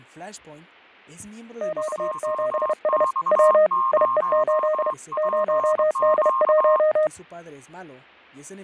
Morse code, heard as two keyed tones, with fading and speech in Spanish. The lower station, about 31 wpm, 620 Hz: Q7S W IE8 0D1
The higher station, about 23 wpm, 1060 Hz: 2X0PQ